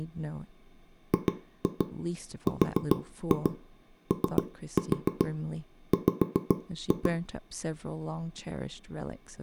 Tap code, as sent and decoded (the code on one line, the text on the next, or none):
2-2 4-2 3-4 5-2
GROW